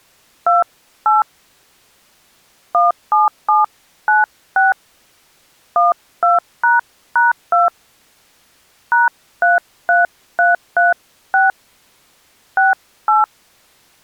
DTMF, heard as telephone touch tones, dialled by hand, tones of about 160 ms. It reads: 28 17796 12##2 #33336 68